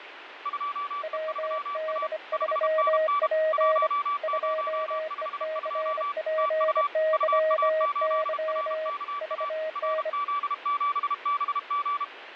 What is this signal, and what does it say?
Morse code, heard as two keyed tones, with radio static. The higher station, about 32 wpm, 1160 Hz: 2E3A 5NN 1052 TU UA8RKA RZ7BG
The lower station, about 25 wpm, 630 Hz: WD3P 2ECPYY VN